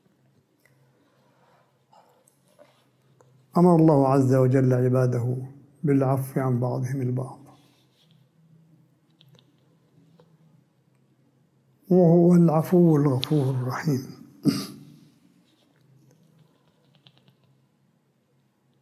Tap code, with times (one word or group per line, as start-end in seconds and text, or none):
none